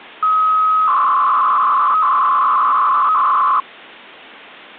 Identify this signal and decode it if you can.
300-baud modem data (Bell 103 tones), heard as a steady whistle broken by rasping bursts, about 300 baud, 200 Hz shift.